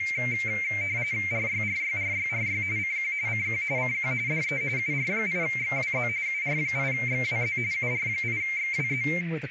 RTTY (45.45 baud, 170 Hz shift), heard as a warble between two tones, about 2200 Hz centre, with radio static, a narrow filter and speech in English. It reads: RYRYRYRY CQ CQ CQ DE UR8XWZ UR8XWZ UR8XWZ